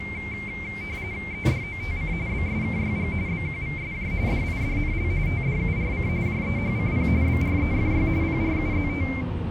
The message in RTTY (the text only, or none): EDOTC BSKYG BQVSJ DIDNL TDURC JEHCP BREFY PRUZT